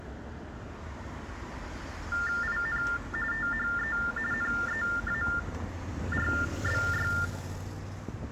TTY/TDD text telephone tones (45.45 baud Baudot), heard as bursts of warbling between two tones, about 400 Hz shift, 1600 Hz centre, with street noise. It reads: IN THE NEARBY